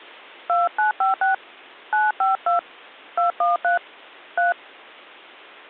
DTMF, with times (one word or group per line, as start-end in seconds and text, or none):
0.5-1.3 2956
1.9-2.6 952
3.2-3.8 213
4.4-4.5 3